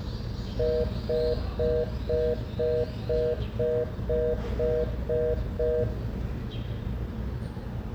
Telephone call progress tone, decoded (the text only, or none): congestion tone